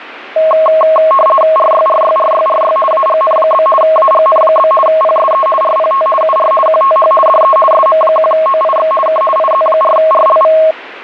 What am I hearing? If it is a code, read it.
RTTY (50 baud, 450 Hz shift), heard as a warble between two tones, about 860 Hz centre, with radio static. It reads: RYRYRYRY AGN? AGN? PSE RPT UR QTH DE SM1OIX K IZ4RLV